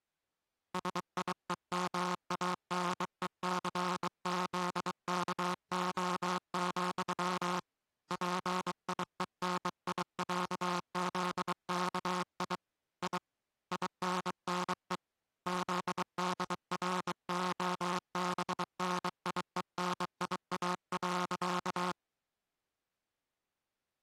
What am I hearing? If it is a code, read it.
Morse code (with Polish letters), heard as a buzzer, hand-sent with a bug key, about 23 wpm. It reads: SIEMANECZKO, PIENIĄZKI I INNE ZDROBNIENIA.